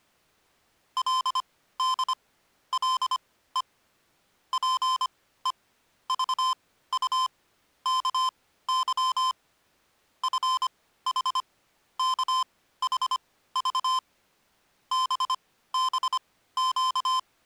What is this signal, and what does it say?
Morse code (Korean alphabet), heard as electronic beeps, machine-sent, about 25 wpm, spaced as for 15 wpm, 1030 Hz. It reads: 그가 자리에 누울 때